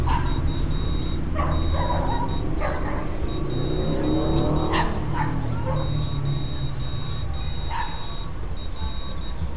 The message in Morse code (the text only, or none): UD P 0R